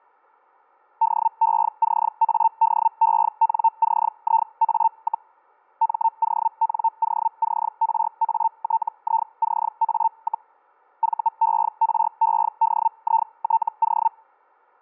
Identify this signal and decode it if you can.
Hellschreiber (Feld-Hell, 122.5 baud), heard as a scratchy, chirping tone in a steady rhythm, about 900 Hz, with static crashes. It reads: DECADENCIA, MONOCRATICA, VEREDITO